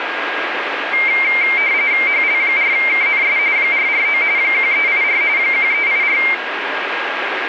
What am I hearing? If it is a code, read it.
RTTY (45.45 baud, 170 Hz shift), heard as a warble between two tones, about 2200 Hz centre, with radio static and a steady whistle near 1630 Hz. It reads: HL4KNS 449 1384 1384